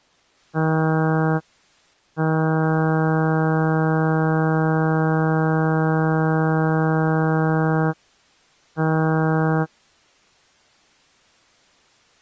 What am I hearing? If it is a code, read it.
Ship horn signal, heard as a ship's horn, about 160 Hz. 1 short, 1 long, 1 short. At sea: a vessel at anchor warns of its position.